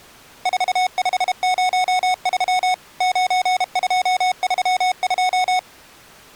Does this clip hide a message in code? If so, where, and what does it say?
Yes: Morse code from 0.4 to 5.7 s, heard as electronic beeps, machine-sent, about 32 wpm, 740 Hz. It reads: 4503 9232